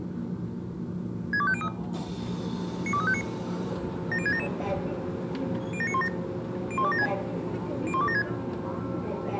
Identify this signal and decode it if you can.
Five-tone selective call (ZVEI), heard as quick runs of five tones, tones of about 70 ms, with the noise inside a subway train. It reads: 62503 92359 70677 07917 01276 01276